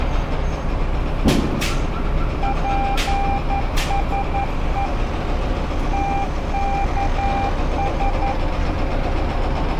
Morse code, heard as a keyed tone, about 11 wpm, 790 Hz, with street noise. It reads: PSE TKS